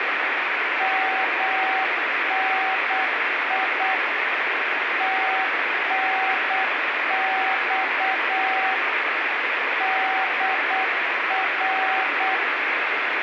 Morse code, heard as a keyed tone, machine-sent, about 8 wpm, 760 Hz, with heavy radio static. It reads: MNI TNX DR